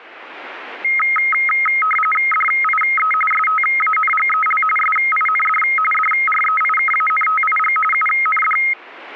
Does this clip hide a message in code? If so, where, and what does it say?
Yes: RTTY (45.45 baud, 850 Hz shift) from 0.8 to 8.7 s, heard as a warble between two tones, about 1700 Hz centre. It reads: DIE STANGEL SIND DREIKANTIG UND